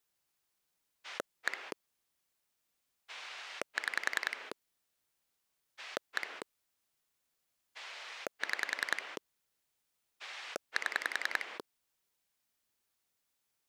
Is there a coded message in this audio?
Yes: pulse dialling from 1.0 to 11.6 s, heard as a rotary dial, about 10 pulses a second. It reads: 1 6 1 6 7